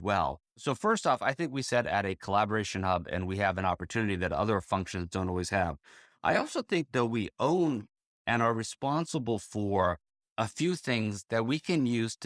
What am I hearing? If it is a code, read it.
Speech in English. There is no code.